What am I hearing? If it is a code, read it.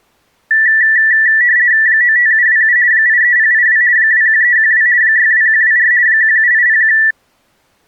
RTTY (50 baud, 170 Hz shift), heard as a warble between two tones, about 1850 Hz centre. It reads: 95727 83082 21312 62124 17801